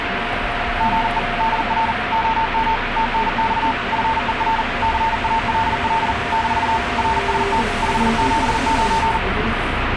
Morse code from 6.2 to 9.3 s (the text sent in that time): - RST 579